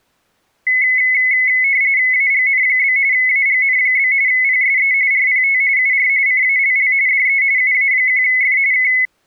RTTY (45.45 baud, 170 Hz shift), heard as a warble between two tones, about 2100 Hz centre. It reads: AGN? AGN? PSE RPT UR CALL DE UA1F K